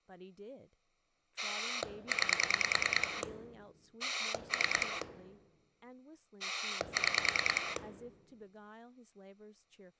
Pulse dialling, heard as a rotary dial, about 9 pulses a second, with speech in English. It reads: 9 3 6